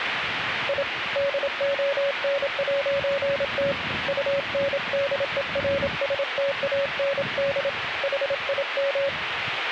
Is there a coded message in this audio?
Yes: Morse code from 0.6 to 9.1 s, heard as a keyed tone, hand-sent with a paddle, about 27 wpm, 560 Hz, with radio static and street noise. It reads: I DON'T UNDERSTAND HIM